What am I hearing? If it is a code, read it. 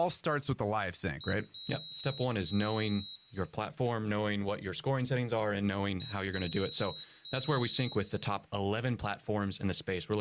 Beep code, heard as a piezo beeper, played twice, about 3850 Hz, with room echo and speech in English. 1 short, 2 long.